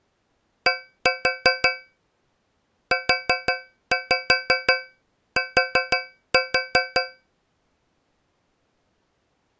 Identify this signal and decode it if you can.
Tap code, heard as taps on a metal pipe, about 5 knocks a second. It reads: D UT